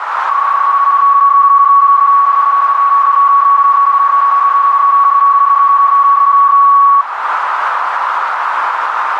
PSK31 (31.25 baud), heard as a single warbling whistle, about 1120 Hz, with radio static and a narrow filter.